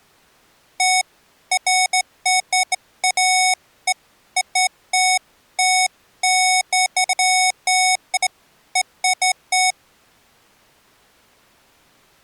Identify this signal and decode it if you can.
Beeps of irregular length. There is no code.